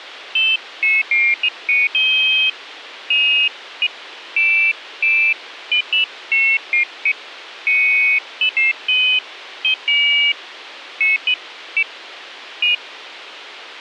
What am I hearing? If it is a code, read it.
Pairs of high tones at irregular times, with radio hiss. There is no code.